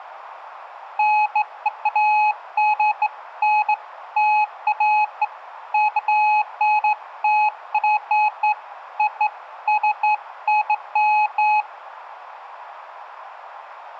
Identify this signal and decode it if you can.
Beeps of irregular length, with room echo. There is no code.